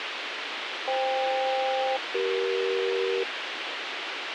Aircraft SELCAL, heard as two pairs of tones, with radio hiss and a squelch burst at the end. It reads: FK-CE